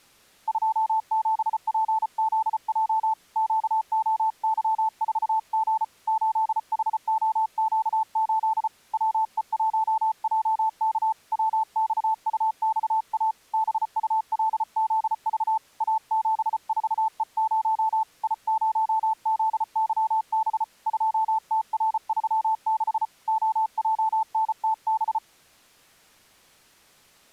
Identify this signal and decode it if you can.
Morse code, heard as a keyed tone, hand-sent with a paddle, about 34 wpm, 880 Hz. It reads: 27PZJ QOY4G 8HOQ8 WE1JK WXUXA BULZV A74E0 I0ZYB 2TR36 OJNTB